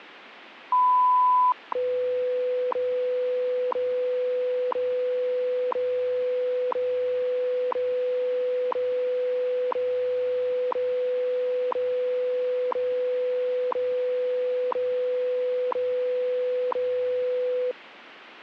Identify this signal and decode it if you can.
Radio time signal (WWV, Colorado), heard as ticks, one a second.